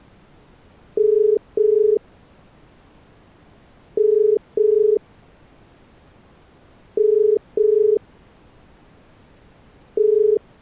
Telephone call progress tone (as in the UK, Ireland, Australia and similar networks), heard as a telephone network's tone, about 430 Hz. Ringback tone.